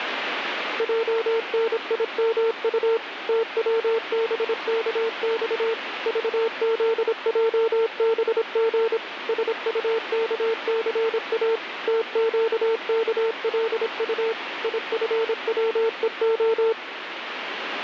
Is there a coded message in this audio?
Yes: Morse code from 0.7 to 16.8 s, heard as a keyed tone, machine-sent, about 26 wpm, 450 Hz, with radio static. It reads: JNIMU TWBKX VZJBG SUKCA TQKLU IFWEO